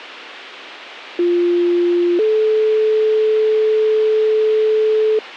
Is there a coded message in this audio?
Yes: two-tone page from 1.2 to 5.2 s, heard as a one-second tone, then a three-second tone, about 350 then 430 Hz.